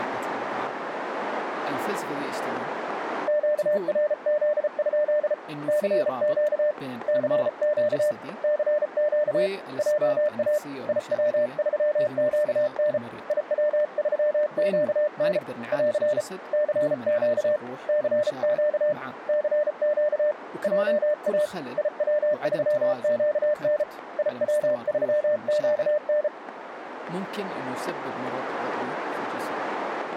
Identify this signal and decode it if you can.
Morse code, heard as a keyed tone, hand-sent with a paddle, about 34 wpm, 600 Hz, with radio static, static crashes and speech in Arabic. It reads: QRZ? CQ CQ CQ JA IW3QN IW3QN <AR> CQ CQ CQ JA IW3QN IW3QN